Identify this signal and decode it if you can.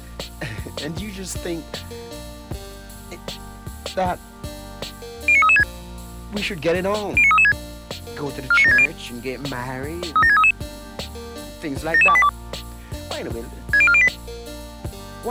Five-tone selective call (ZVEI), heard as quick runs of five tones, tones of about 70 ms. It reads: 09336 09336 49760 37633 77282 60408